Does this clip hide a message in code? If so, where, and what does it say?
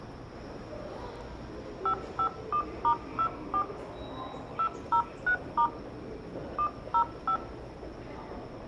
Yes: DTMF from 1.9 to 7.4 s, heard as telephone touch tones, dialled by hand, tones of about 80 ms, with room echo and the noise of a subway station. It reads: 551*24 203* 105